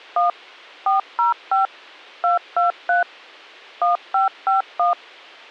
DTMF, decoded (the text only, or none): 1 405 223 1551